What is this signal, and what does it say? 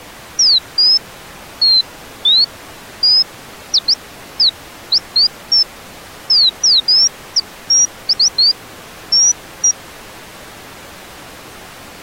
Bird-like chirps. There is no code.